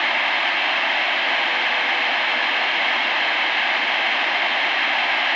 Morse code, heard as a keyed tone, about 21 wpm, 480 Hz, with heavy radio static. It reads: 2ZWGS